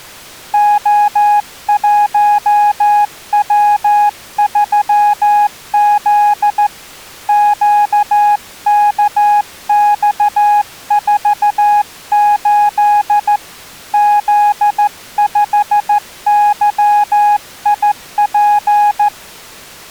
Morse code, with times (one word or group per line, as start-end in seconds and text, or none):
0.5-6.7 O1W3Z
7.3-13.4 QKX48
13.9-19.1 Z5YIP